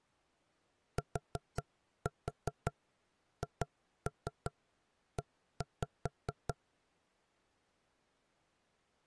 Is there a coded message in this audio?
Yes: tap code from 1.0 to 6.6 s, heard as knocks on wood, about 5 knocks a second. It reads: THE